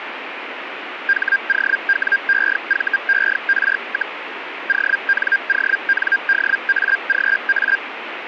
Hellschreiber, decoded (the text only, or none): HOWEVER, ONONDAGA